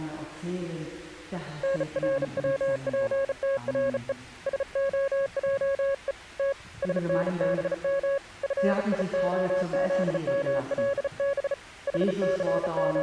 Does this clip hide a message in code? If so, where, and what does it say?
Yes: Morse code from 1.6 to 13.0 s, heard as a keyed tone, hand-sent with a bug key, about 35 wpm, 550 Hz. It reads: NRWPTRE SOJE T SNBM FIOZMLB …